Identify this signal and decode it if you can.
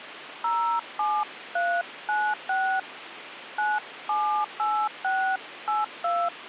DTMF, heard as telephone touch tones, dialled by hand, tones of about 260 ms, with phone line noise. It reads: 07396 978682